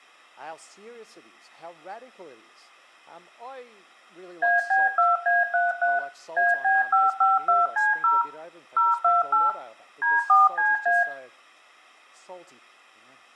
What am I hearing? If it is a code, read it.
DTMF, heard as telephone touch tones, dialled by machine, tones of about 180 ms, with room echo. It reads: AB2A33 AB552C0 028 D4CA